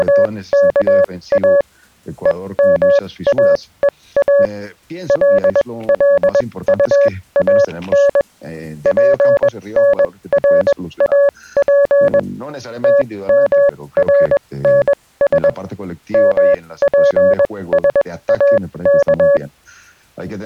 Morse code, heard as a keyed tone, machine-sent, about 21 wpm, spaced as for 17 wpm, 560 Hz. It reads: … EMAEA LLUAN PNRAP TMRNS MPSAK